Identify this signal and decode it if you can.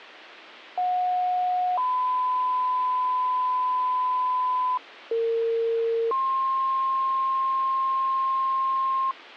Two-tone page, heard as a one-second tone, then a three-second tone, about 730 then 1010 Hz, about 460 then 1060 Hz.